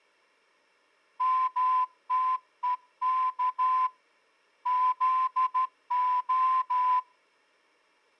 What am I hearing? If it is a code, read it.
Morse code (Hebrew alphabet), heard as a whistle, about 12 wpm. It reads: מתוך זה